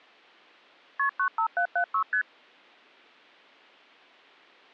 Multi-frequency trunk signalling (R1, as on North American trunks), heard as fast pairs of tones, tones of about 90 ms. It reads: KP 95776 ST